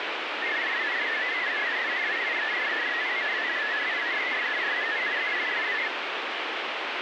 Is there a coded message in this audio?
Yes: multi-tone FSK (Olivia or MFSK type), about 500 Hz wide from 0.4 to 5.9 s, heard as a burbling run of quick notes, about 62.5 baud, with radio static.